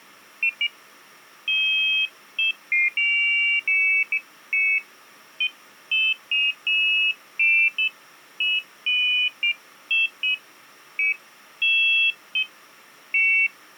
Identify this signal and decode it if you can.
Pairs of high tones at irregular times. There is no code.